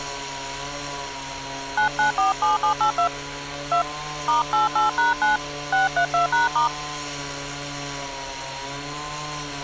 DTMF, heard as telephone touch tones, dialled by hand, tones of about 120 ms, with street noise. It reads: 9947782 2 *88#9 632#*